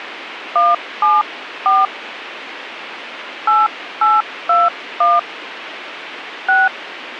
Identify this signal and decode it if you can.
DTMF, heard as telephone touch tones, dialled by hand, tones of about 190 ms, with radio hiss. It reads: 174 8821 6